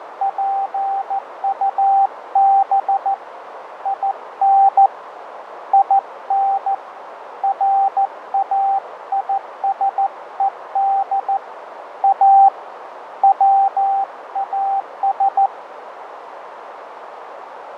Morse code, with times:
0.2-3.1 PUB
3.9-4.9 IN
5.7-6.7 IN
7.4-11.4 RAISED
12.0-12.5 A
13.2-15.5 WAS

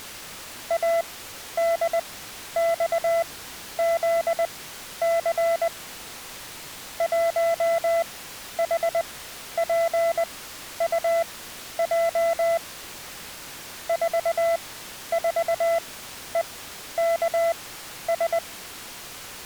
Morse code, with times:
0.7-5.7 ADXZC
7.0-12.6 1HPUJ
13.9-18.4 44EKS

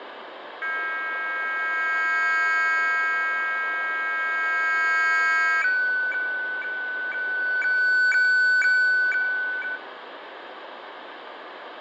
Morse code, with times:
none

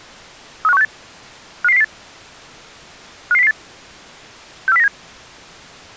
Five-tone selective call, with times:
0.6-0.8 35168
1.6-1.8 55008
3.3-3.5 55008
4.7-4.9 64097

